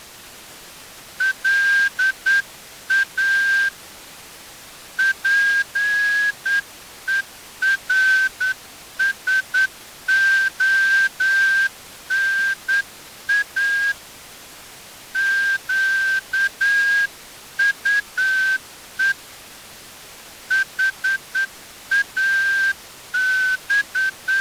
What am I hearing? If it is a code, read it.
Morse code, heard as a whistle, hand-sent with a straight key, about 9 wpm. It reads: LA PERSONA QUE …